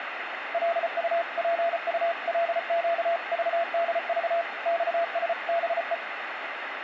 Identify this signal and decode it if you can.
Morse code (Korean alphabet), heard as a keyed tone, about 34 wpm, 680 Hz, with radio static. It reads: 기지개를 켜다